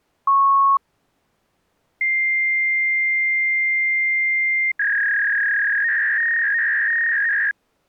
Fax machine handshake, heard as a beep, a long tone and a warble.